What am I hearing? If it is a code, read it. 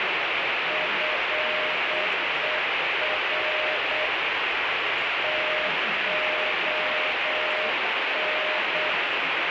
Morse code (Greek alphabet), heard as a keyed tone, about 8 wpm, 620 Hz, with heavy radio static and the noise of a restaurant. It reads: ΦΕΡ ΤΟΝ